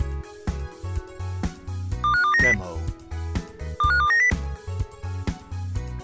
Five-tone selective call (CCIR), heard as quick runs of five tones, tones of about 100 ms. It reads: 25290 25290